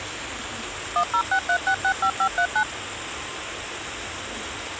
DTMF, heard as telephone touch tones, dialled by machine, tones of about 80 ms, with phone line noise and kitchen noise. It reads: 1063665539